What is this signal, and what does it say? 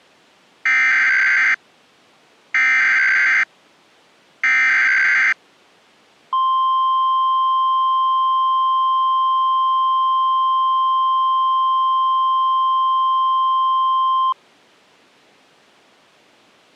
Emergency Alert System (SAME) tones (header bursts, then the 1050 Hz attention tone), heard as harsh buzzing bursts, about 520.83 baud.